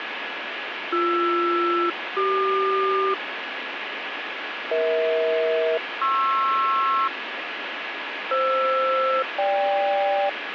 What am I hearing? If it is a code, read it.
Aircraft SELCAL, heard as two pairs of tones, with radio static. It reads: BR-CQ EH-PR FR-GK